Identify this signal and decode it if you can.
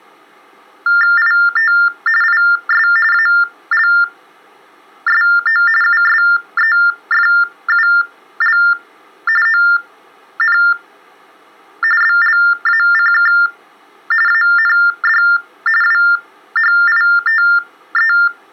TTY/TDD text telephone tones (45.45 baud Baudot), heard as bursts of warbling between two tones, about 400 Hz shift, 1600 Hz centre. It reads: IT IS ALSO USEFUL ON BLACK AND WHITE